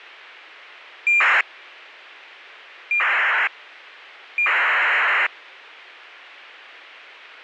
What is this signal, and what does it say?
ACARS aircraft data, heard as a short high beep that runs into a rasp, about 2400 baud.